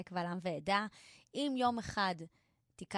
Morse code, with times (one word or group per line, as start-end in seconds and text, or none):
none